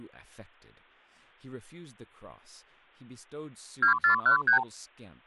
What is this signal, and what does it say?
Multi-frequency trunk signalling (R2, with the far end's replies), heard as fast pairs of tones, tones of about 110 ms, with speech in English. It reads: 2413